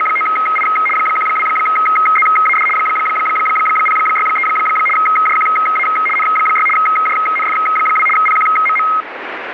RTTY (75 baud, 850 Hz shift), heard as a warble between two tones, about 1700 Hz centre, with radio static. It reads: … 12ZAD 063 JQA N6 JNF2 PQMM